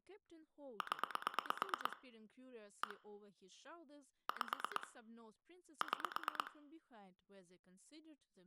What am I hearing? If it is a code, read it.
Pulse dialling, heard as clicks on a phone line, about 8 pulses a second, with room echo and speech in English. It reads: 0 1 5 6